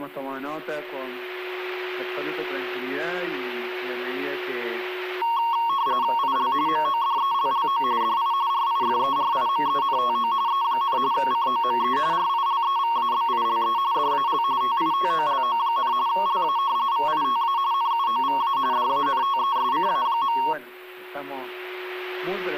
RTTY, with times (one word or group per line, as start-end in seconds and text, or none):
6.2-6.5 IL
6.7-7.8 MODELLO
8.0-8.3 DI
8.5-10.3 RIFERIMENTO
10.5-11.0 E,
11.1-12.0 COME
12.1-13.8 RILEVABILE
13.9-14.4 DAL
14.6-15.9 TITOLO,
16.1-16.6 LA
16.9-17.6 VITA
17.7-18.6 NUOVA
18.7-20.4 DANTESCA.